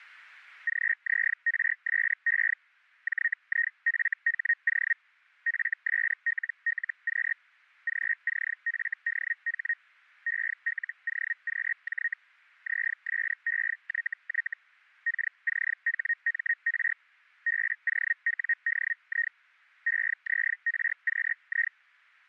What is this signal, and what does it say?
Hellschreiber (Feld-Hell, 122.5 baud), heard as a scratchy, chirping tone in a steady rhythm, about 1850 Hz. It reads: GZRSE JIFHO FSLLQ GCFDH ELOQJ ZSEYY KCHMR BOWDI EZRQI